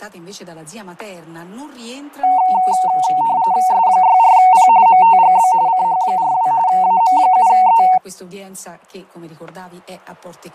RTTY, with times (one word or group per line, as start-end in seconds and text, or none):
3.7-4.7 S64P
4.9-5.5 MTGB
5.7-6.5 CH42
6.7-7.8 AM7E